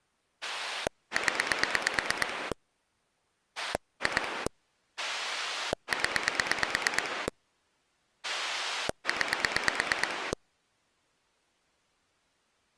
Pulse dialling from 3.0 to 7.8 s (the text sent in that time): 2 0